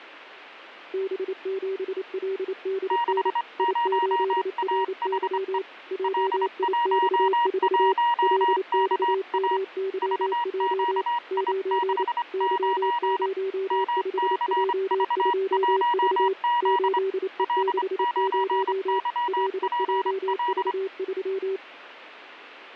Morse code, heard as two keyed tones, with radio static. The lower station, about 28 wpm, 380 Hz: B7LDN I8RY JIX4 LXMYJ 9 Y05J2V 8E60 LJV3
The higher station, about 25 wpm, 950 Hz: 60AHE L11KA VQI69 MCV1Z L9YPL